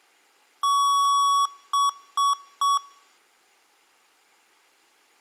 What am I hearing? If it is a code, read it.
Beep code, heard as beeps from a small speaker, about 1120 Hz. 1 long, 3 short. In Award and IBM BIOS tables: video adapter failure; in AMI BIOS tables: memory failure.